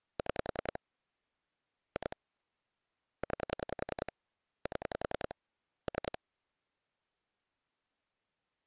Pulse dialling, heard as clicks on a phone line, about 10 pulses a second. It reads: 6 2 9 7 3